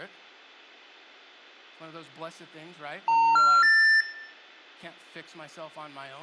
Telephone call progress tone (North American plan), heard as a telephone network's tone, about 910, 1370, 1800 Hz, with room echo and speech in English. Special information tone.